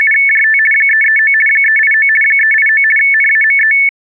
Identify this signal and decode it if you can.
RTTY (50 baud, 450 Hz shift), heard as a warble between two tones, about 2000 Hz centre. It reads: … 339 389 389 NAME